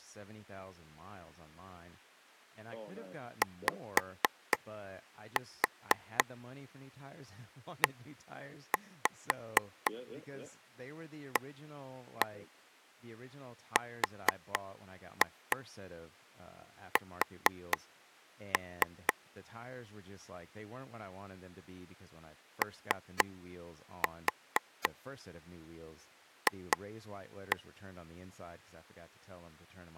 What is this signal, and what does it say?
Tap code, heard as taps on a table, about 4 knocks a second, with speech in English. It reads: YEARS OF